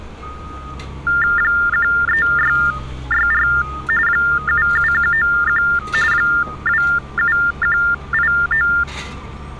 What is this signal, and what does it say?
TTY/TDD text telephone tones (45.45 baud Baudot), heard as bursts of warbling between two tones, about 400 Hz shift, 1600 Hz centre, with street noise. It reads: 13664 77191 27189